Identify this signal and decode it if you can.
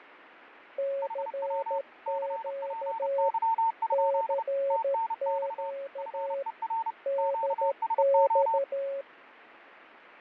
Morse code, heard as two keyed tones, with radio static and fading. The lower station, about 13 wpm, 550 Hz: CQ CQ DX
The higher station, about 30 wpm, 900 Hz: HW CPY? TNX FER QSO